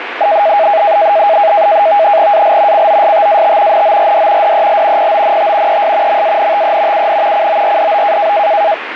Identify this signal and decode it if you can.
NAVTEX (SITOR-B), 100 baud, 170 Hz shift, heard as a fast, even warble, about 730 Hz centre, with radio static. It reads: AL COSTAT NORD DEL PONT ES MANTE UN CORDO